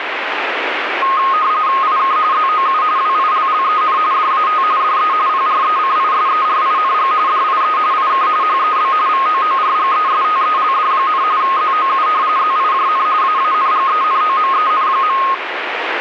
RTTY (45.45 baud, 170 Hz shift), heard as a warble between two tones, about 1160 Hz centre, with radio static. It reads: IK ZOU WILLEN DAT DE PRECISERING DIE IK HEB VOORGESTELD, ZOU ZIJN AANGENOMEN.